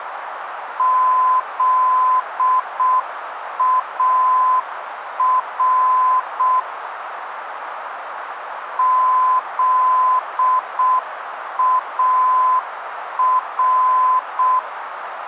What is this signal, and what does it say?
Morse code, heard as a keyed tone, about 6 wpm, 1020 Hz, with radio static and a narrow filter. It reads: ZAR ZAR